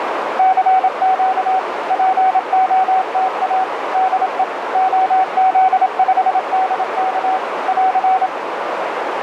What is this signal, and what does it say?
Morse code, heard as a keyed tone, machine-sent, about 27 wpm, 760 Hz, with radio static and a narrow filter. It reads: CQ POTA DE OZ5DK <AR>